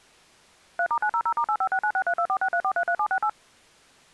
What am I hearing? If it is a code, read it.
DTMF, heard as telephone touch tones, dialled by machine, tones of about 70 ms. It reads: 3*900*8569632463433768